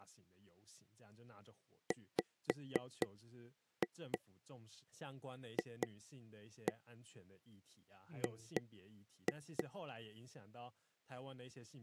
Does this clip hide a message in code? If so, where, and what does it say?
Yes: tap code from 1.9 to 9.6 s, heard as taps on a table, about 4 knocks a second, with speech in Chinese. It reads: WFG